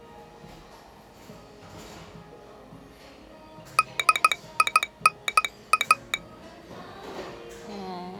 Morse code, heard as a telegraph sounder, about 15 wpm, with the noise of a cafe. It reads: DINA